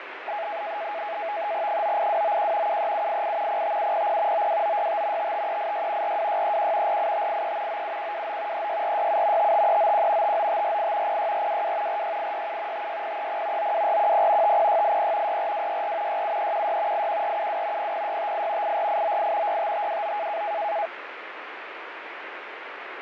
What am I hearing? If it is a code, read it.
NAVTEX (SITOR-B), 100 baud, 170 Hz shift, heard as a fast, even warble, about 750 Hz centre, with radio static and fading. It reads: 98291 73788 05700 92965 55386 42631 48583 97129 36467 55391 59548 06422 46867 56030 92410 50680 64264 67316 81472 00658 84898 65529